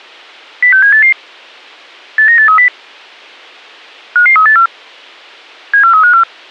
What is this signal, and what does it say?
Five-tone selective call (CCIR), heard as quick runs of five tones, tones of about 100 ms, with a squelch burst at the end. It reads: 06788 89830 55384 74354